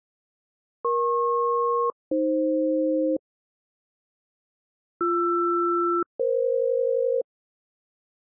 Aircraft SELCAL, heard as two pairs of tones. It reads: EP-AF BR-EF